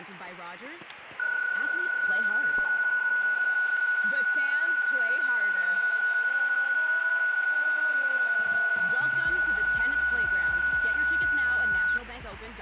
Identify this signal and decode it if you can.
PSK31 (31.25 baud), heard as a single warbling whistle, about 1470 Hz.